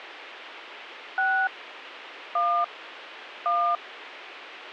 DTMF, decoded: 6 1 1

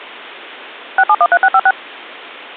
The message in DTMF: 6713656

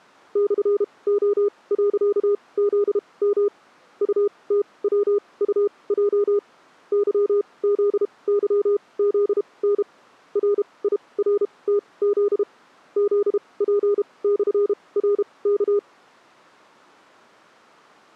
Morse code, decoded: /O.ZM UTWUJ YZYZN RIRTZ ZP/RK

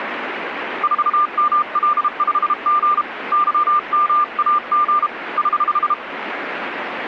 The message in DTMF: none

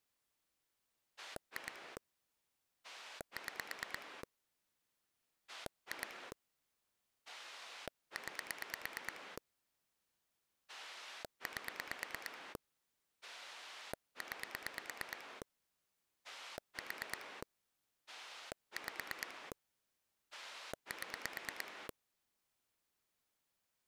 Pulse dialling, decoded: 2 6 2 9 8 9 4 5 7

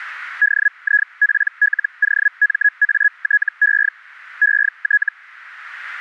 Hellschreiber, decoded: DIPLOMATE ET

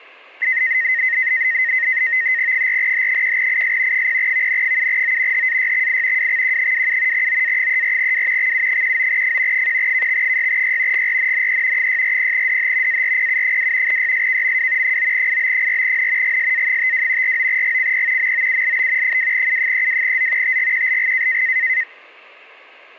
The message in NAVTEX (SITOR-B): 4H1IS 0VN7O HAYXI WXQ27 OA34W XU19F 1KX6Y GRNNE 640DH ARPU2 YSKMW 9IB4N GSA52 49GCP MOULB 2U32Z TGQLG

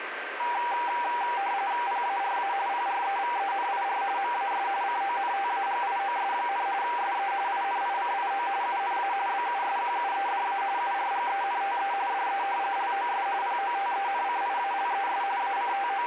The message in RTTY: PARA PREVENIR MAS CONTAGIOS, SE INICIO UNA BUSQUEDA URGENTE DE LOS POTENCIALES …

